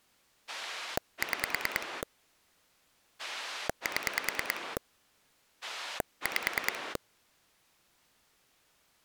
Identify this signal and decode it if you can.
Pulse dialling, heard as a rotary dial, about 9 pulses a second. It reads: 6 7 5